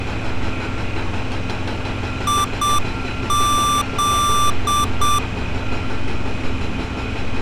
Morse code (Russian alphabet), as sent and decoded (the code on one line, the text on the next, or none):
.. --..
ИЗ